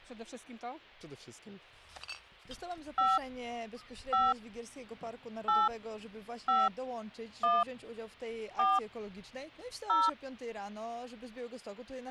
DTMF, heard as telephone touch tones, dialled by hand, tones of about 200 ms. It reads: 5 5 8 5 1 4 0